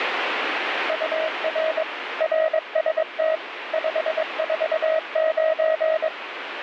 Morse code, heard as a keyed tone, machine-sent, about 22 wpm, 640 Hz, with radio static. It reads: UR RST 549